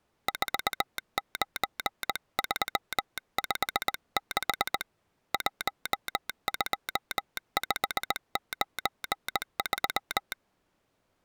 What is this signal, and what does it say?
Morse code, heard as a telegraph sounder, hand-sent with a straight key, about 19 wpm. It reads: 49356 12593